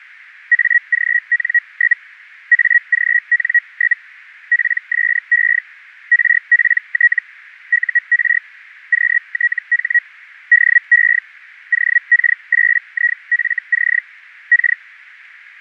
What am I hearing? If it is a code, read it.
Hellschreiber (Feld-Hell, 122.5 baud), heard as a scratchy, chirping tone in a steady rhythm, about 1900 Hz. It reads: AGN? AGN? PSE RPT UR QTH DE OK8IFC K